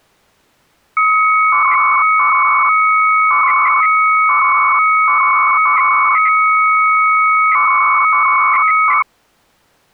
300-baud modem data (Bell 103 tones), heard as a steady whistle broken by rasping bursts, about 300 baud, 200 Hz shift.